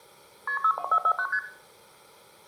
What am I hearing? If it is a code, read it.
Multi-frequency trunk signalling (R1, as on North American trunks), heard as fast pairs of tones, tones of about 70 ms, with room echo. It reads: KP 62449 ST